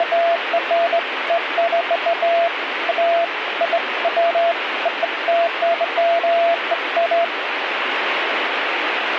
Beeps of irregular length, with radio static. There is no code.